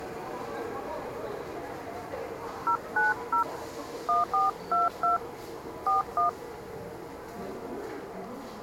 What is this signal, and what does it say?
DTMF, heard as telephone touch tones, dialled by hand, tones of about 140 ms, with the noise of a subway station. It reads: 090 1422 41